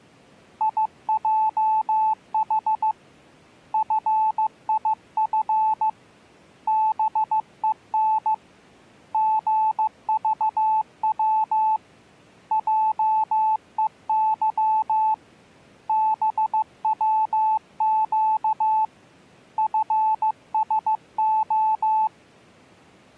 Morse code, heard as a keyed tone, hand-sent with a paddle, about 15 wpm, 870 Hz. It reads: IJH FIF BEN GVW JEY BWQ FSO